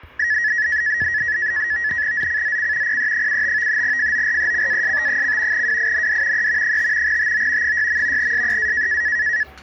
NAVTEX (SITOR-B), 100 baud, 170 Hz shift, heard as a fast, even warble, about 1800 Hz centre, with the noise of a restaurant. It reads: ZCZC PE75 FORECAST: WIND E 5 TO 6. SEA